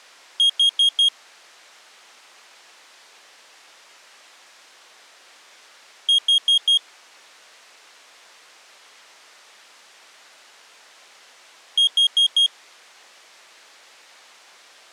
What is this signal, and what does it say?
Alarm pattern, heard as an alarm's beeps, played three times, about 3250 Hz. Temporal four. Carbon monoxide.